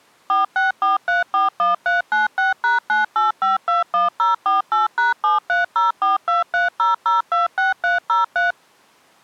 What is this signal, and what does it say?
DTMF, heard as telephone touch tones, dialled by machine, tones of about 150 ms. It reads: 464341396#98521048#7304230026303